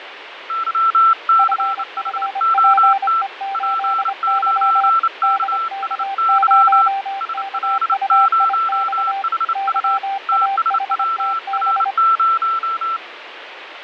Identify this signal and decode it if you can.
Morse code, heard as two keyed tones, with radio static and fading. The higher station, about 29 wpm, 1340 Hz: YCHOT P9KSY SL0HU TSWR0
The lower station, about 25 wpm, 780 Hz: FFPE8Y DK0KUIX YAHTB